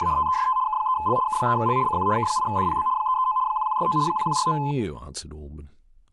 RTTY (75 baud, 170 Hz shift), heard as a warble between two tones, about 940 Hz centre, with speech in English. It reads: … TEST K3L K3L CQ K8DPB 339 1169 1169